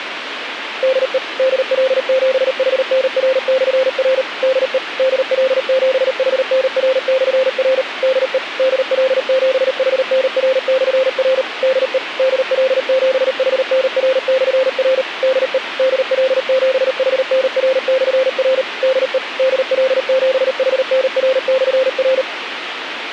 Morse code, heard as a keyed tone, machine-sent, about 38 wpm, 520 Hz, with radio hiss. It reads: DE DL7HNR/R DE DL7HNR/R DE DL7HNR/R DE DL7HNR/R DE DL7HNR/R DE DL7HNR/R